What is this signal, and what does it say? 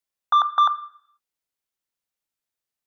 Beep code, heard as beeps, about 1180 Hz, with room echo. 2 short. In AMI BIOS tables: memory parity error; in IBM BIOS tables: self-test error shown on screen; in Dell tables: no memory detected.